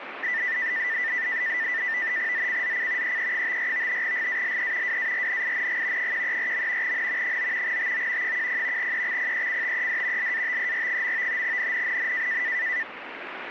NAVTEX (SITOR-B), 100 baud, 170 Hz shift, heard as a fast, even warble, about 1900 Hz centre, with radio static. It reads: ZCZC EE54 GALE WARNING 134. N 9 TO 10 EXPECTED LATER. NNNN